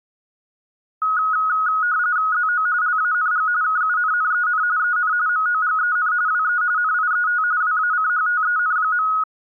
RTTY (45.45 baud, 170 Hz shift), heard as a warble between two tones, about 1360 Hz centre. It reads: ZO LANG KUNNEN EN MOGEN WE NIET WACHTEN.